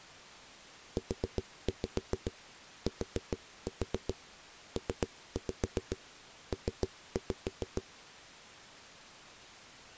Tap code, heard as knocks on a wall, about 7 knocks a second. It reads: UTPP